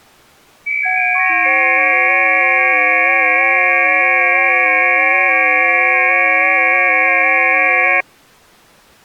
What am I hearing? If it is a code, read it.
FT8 (several signals at once), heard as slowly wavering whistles, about 6.25 baud.